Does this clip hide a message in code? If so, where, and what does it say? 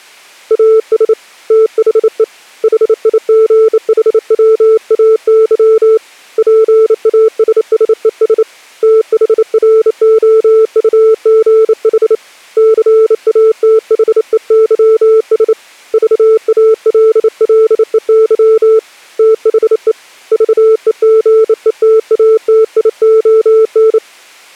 Yes: Morse code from 0.4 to 24.0 s, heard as a keyed tone, hand-sent with a bug key, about 28 wpm, 440 Hz. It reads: AS THE HIGHWAY PASSES THROUGH CATHEYS VALLEY THE VEGETATION